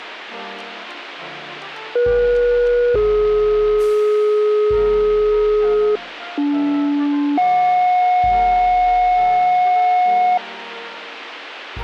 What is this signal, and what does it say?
Two-tone page, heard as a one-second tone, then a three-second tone, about 480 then 420 Hz, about 290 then 730 Hz.